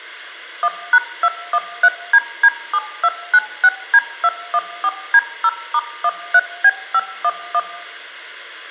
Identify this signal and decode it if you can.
DTMF, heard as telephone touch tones, dialled by machine, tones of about 50 ms, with room echo. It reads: 1#213DD7296D214D0*13B511